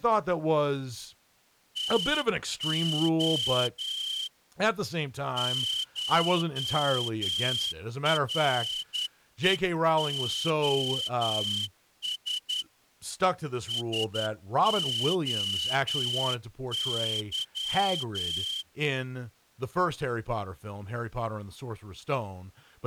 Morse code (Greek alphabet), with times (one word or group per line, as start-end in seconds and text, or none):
1.8-4.3 ΤΟ
5.4-12.6 ΧΡΕΟΣ
13.7-18.6 ΣΟΥ